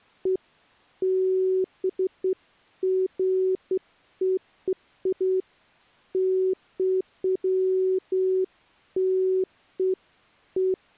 Beeps of irregular length. There is no code.